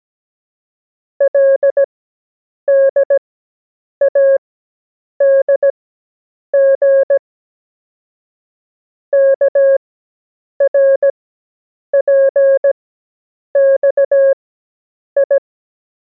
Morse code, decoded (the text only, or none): LDADG KRPXI